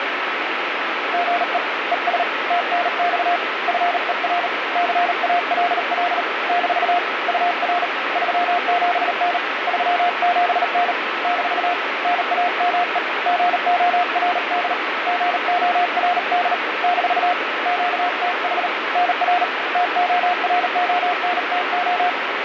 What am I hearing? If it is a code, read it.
Morse code, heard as a keyed tone, hand-sent with a paddle, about 38 wpm, 710 Hz, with radio static. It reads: GE ES TNX FER CALL - UR 37N 37N - NAME GORD GORD - QTH NR TORONTO